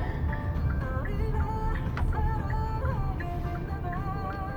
The noise inside a car. There is no code.